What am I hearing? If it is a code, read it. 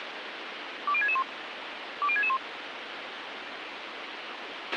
Five-tone selective call (ZVEI), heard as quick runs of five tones, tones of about 70 ms, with radio hiss and a squelch burst at the end. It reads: 20661 20661